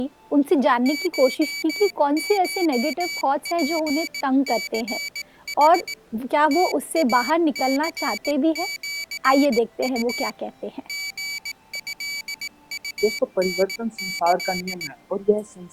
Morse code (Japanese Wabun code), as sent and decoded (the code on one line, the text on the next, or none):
---- ---- .--. -.-. .... / - .- -.-. --.-. ..- / --. ..-.. ..- -. -.-..
ココツニヌ ムイニシウ リトウタキ